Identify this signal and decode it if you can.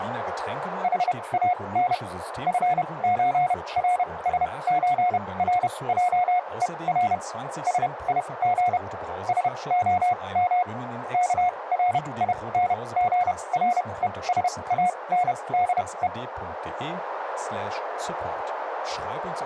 Morse code (with Swedish letters), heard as a keyed tone, machine-sent, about 31 wpm, spaced as for 23 wpm, 720 Hz, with radio static, a narrow filter and speech in German. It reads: HAN FÖRSÖRJER SIG SOM KRINGRESANDE